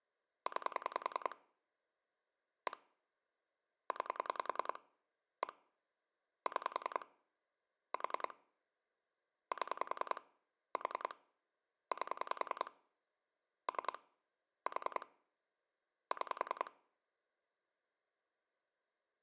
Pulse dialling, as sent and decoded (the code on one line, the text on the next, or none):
9 / 1 / 9 / 1 / 6 / 4 / 7 / 4 / 8 / 3 / 4 / 6
9 1 9 1 6 4 7 4 8 3 4 6